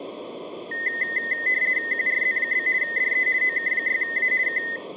RTTY (50 baud, 170 Hz shift), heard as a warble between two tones, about 1950 Hz centre, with room echo. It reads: QRZ? DE OK6A K